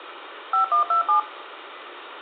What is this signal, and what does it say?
DTMF, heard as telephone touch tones, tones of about 120 ms, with phone line noise and room echo. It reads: 5127